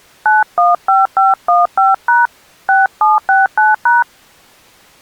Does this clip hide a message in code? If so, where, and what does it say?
Yes: DTMF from 0.3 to 4.0 s, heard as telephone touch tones, dialled by hand, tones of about 170 ms. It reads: 915515# 6769#